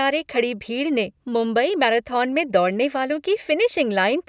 Speech in Hindi. There is no code.